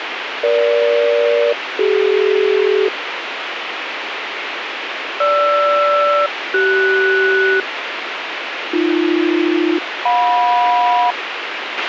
Aircraft SELCAL, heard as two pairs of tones, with radio hiss and a squelch burst at the end. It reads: EG-CD GR-CS AB-JM